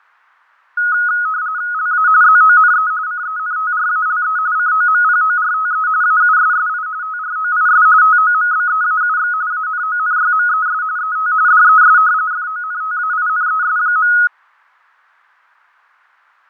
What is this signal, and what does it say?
RTTY (45.45 baud, 170 Hz shift), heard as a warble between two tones, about 1360 Hz centre, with fading. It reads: LA ZONE CENTRALE COMPORTE AUSSI TROIS TOMBEAUX ANONYMES ET DES FONTAINES.